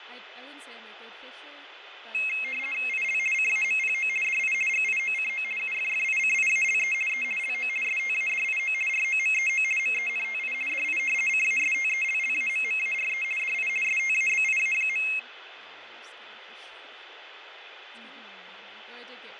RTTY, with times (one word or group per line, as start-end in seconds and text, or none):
2.9-3.2 IL
3.3-4.1 CAMPO
4.2-4.5 DI
4.7-5.4 GIOCO
5.6-6.9 UFFICIALE
7.1-7.2 E
7.4-7.7 LO
7.8-8.7 STADIO
8.9-9.6 ROMEO
9.8-10.5 MENTI
10.7-11.0 DI
11.3-13.2 CASTELLAMMARE
13.4-13.7 DI
13.8-15.0 STABIA.